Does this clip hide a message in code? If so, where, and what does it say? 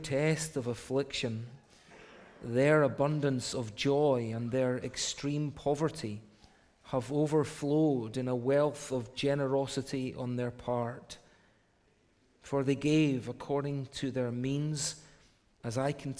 No.